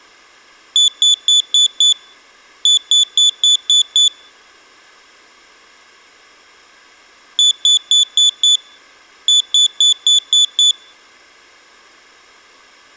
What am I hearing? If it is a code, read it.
Beep code, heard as a piezo beeper, played twice, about 3450 Hz, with room echo. 5-6.